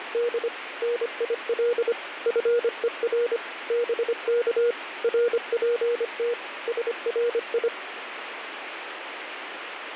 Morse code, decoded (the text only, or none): … NIL FER BK RPT SRI